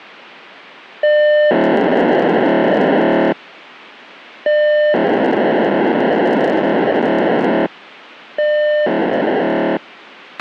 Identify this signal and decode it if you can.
POCSAG pager data (1200 baud), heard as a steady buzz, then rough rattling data, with a squelch burst at the end.